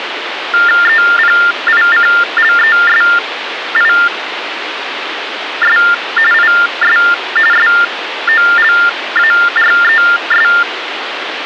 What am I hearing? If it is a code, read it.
TTY/TDD text telephone tones (45.45 baud Baudot), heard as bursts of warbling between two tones, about 400 Hz shift, 1600 Hz centre, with phone line noise. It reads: EPICLESIS IS SOLARES